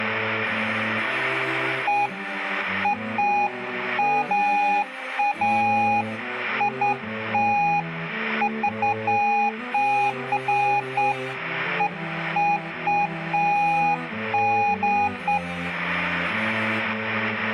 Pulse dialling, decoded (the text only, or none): none